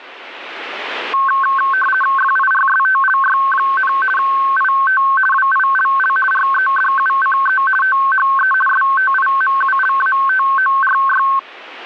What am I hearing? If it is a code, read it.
RTTY (50 baud, 450 Hz shift), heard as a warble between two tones, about 1310 Hz centre. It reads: FIRSTLY, IT WILL REDUCE THE STIMULATORY